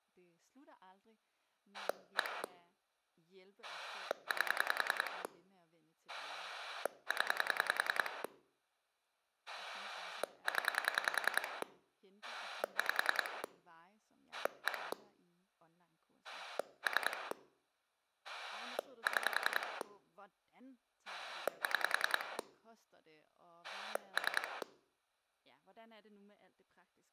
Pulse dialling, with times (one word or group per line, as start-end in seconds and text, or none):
1.7-2.4 1
3.6-5.2 8
6.1-8.2 0
9.5-11.6 0
12.2-13.4 5
14.3-14.9 1
16.2-17.3 3
18.2-19.8 6
21.1-22.4 6
23.6-24.6 3